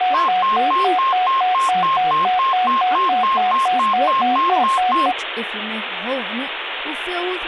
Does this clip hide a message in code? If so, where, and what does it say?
No, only a tone that alternates evenly between two pitches, with phone line noise and speech in English.